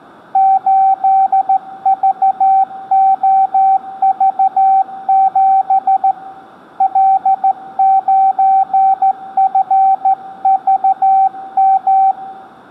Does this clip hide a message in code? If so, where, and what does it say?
Yes: Morse code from 0.3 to 12.2 s, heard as a keyed tone, hand-sent with a straight key, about 14 wpm, 770 Hz, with room echo. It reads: 8VOV7 L9FVM